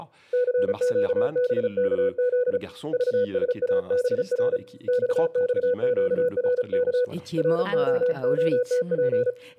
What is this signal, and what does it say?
Morse code, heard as a keyed tone, hand-sent with a paddle, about 35 wpm, 500 Hz, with room echo and speech in French. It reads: CQBKZ VSABR XXQRK ROOTP